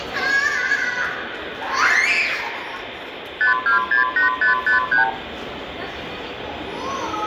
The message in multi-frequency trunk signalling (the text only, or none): 5268553